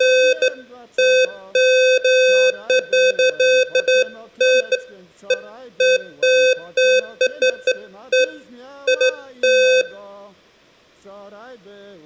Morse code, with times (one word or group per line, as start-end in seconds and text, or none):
none